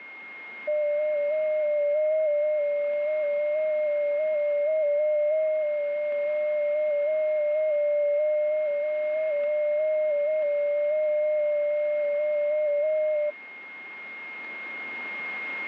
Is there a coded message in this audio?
Yes: FT8 (one signal) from 0.7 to 13.3 s, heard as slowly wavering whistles, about 6.25 baud, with a steady whistle near 2140 Hz.